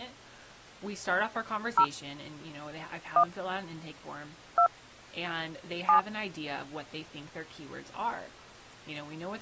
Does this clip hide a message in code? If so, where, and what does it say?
Yes: DTMF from 1.8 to 6.0 s, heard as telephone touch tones, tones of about 90 ms, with speech in English. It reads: 0 1 2 7